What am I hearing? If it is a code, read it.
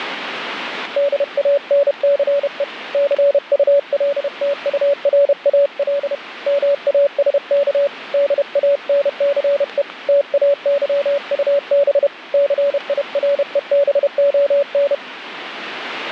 Morse code, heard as a keyed tone, hand-sent with a paddle, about 31 wpm, 570 Hz, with radio static. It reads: DANCE CULTURAL MASK DANCE TAYUB CIREBON